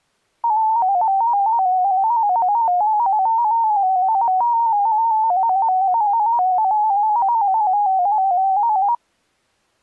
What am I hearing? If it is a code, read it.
Multi-tone FSK (Olivia or MFSK type), about 250 Hz wide, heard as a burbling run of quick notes, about 15.625 baud.